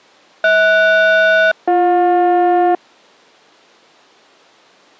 Aircraft SELCAL, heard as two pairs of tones. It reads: HS-BJ